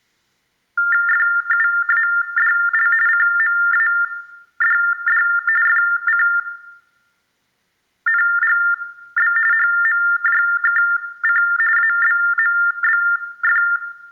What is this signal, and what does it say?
TTY/TDD text telephone tones (45.45 baud Baudot), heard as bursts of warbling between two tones, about 400 Hz shift, 1600 Hz centre, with room echo. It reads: FUADL CMADD FCNGB HMJKC ABMBF